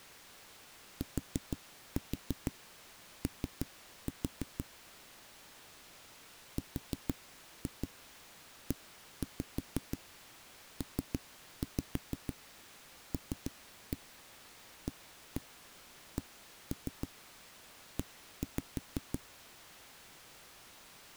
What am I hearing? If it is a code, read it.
Tap code, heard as knocks on a wall, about 6 knocks a second. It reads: TO REPLACE